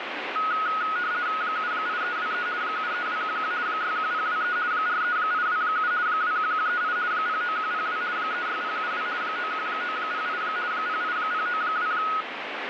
RTTY (50 baud, 170 Hz shift), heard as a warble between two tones, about 1360 Hz centre, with radio static. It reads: 78323 73211 61023 43827 21138 09102 36072 91908 08092